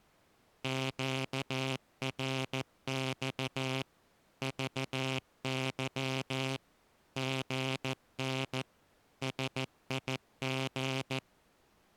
Morse code, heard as a buzzer, machine-sent, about 14 wpm. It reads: QRX VY GN SIG